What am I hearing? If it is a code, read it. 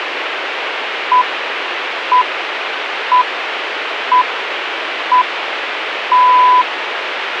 Radio time signal (six pips, as the Greenwich Time Signal), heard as pips, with radio hiss.